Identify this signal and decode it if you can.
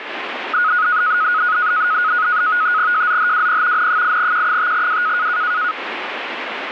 NAVTEX (SITOR-B), 100 baud, 170 Hz shift, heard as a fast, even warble, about 1360 Hz centre, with radio static. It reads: JZHWP N8Q5W